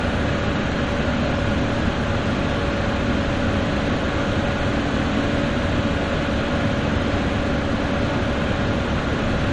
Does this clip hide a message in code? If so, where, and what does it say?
No, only street noise.